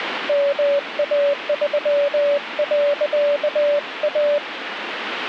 Morse code, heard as a keyed tone, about 20 wpm, 570 Hz, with radio static. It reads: MA3.A